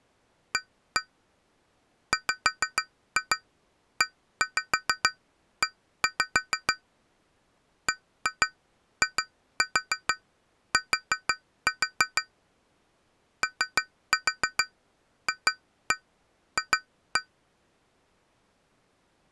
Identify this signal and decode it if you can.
Tap code, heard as taps on glass, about 6 knocks a second. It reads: A WEE BIT OFF